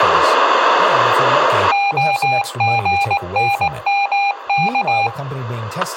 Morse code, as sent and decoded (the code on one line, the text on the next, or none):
--- --. -. -- -.-
OGNMK